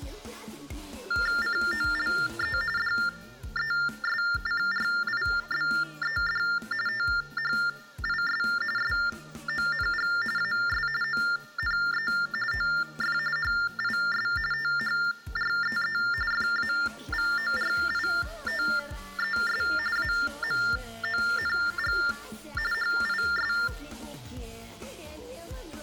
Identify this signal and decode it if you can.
TTY/TDD text telephone tones (45.45 baud Baudot), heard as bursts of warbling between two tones, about 400 Hz shift, 1600 Hz centre. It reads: COLE DESCRIBED THIS SONG AS ONE OF HIS THREE FAVORITES AMONG HIS